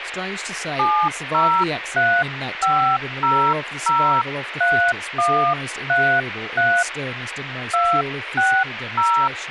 DTMF, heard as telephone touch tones, dialled by hand, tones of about 300 ms, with radio hiss and speech in English. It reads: 7035003133 260